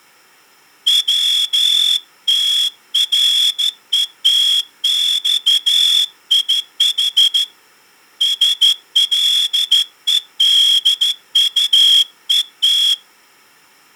Morse code (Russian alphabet), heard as a whistle, hand-sent with a straight key, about 13 wpm. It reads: ВТРЕТЬИХ СЛЕДУЕТ